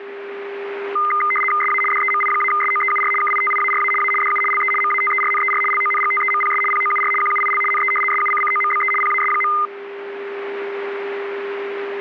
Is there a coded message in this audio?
Yes: RTTY (75 baud, 850 Hz shift) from 1.0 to 9.7 s, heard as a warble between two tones, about 1650 Hz centre, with a steady whistle near 400 Hz. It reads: SA DEMI-SOEUR KITIARA A DU LE MATERNER LONGTEMPS POUR QUIL NE SUCCOMBE PAS.